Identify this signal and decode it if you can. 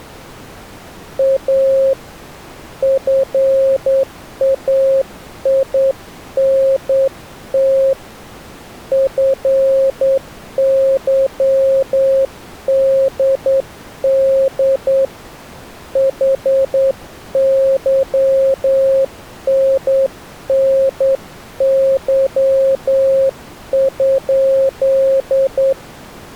Morse code, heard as a keyed tone, hand-sent with a straight key, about 9 wpm, 540 Hz. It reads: A FAINT FYDD HYNNY?